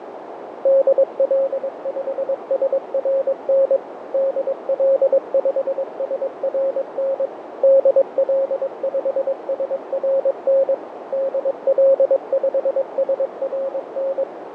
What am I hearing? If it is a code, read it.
Morse code, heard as a keyed tone, machine-sent, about 22 wpm, 540 Hz, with radio static, fading and a narrow filter. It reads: DL5SRN DL5SRN DL5SRN DL5SRN